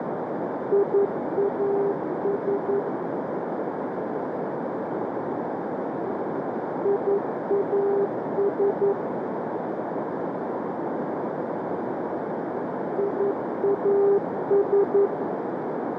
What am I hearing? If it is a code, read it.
Morse code, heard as a keyed tone, machine-sent, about 11 wpm, 400 Hz, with heavy radio static and a narrow filter. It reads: IAS IAS IAS